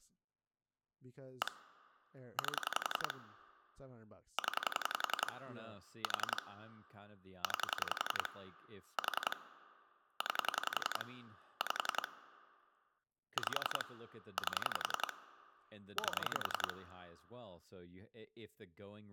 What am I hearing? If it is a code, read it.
Pulse dialling, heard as clicks on a phone line, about 11 pulses a second, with speech in English. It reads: 1 8 0 4 9 4 9 5 5 8 8